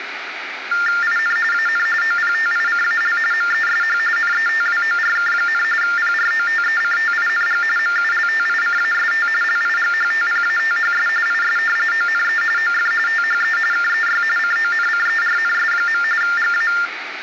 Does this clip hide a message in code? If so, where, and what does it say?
Yes: TTY/TDD text telephone tones (45.45 baud Baudot) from 0.7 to 16.9 s, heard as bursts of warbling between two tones, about 400 Hz shift, 1600 Hz centre, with phone line noise. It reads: IN AN OPTICAL MESH NETWORK, PROTECTING MULTICAST LIGHTPATHS IS ONE OF THE KEY CONCERNS. GA